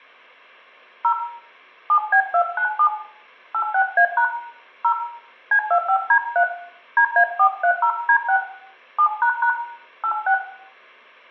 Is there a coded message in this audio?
Yes: DTMF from 1.0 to 10.3 s, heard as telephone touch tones, dialled by hand, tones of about 80 ms, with room echo. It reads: 0 7B297 86A# 0 C25D3 DA430D6 7## 86